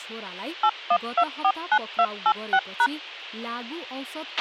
DTMF, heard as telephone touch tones, dialled by machine, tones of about 60 ms, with a squelch burst at the end and speech in Nepali. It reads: 81249286#